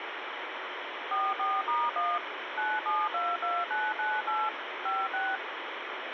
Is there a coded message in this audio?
Yes: DTMF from 1.1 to 5.4 s, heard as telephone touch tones, dialled by machine, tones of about 220 ms, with radio hiss and a squelch burst at the end. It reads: 44*1 9722998 56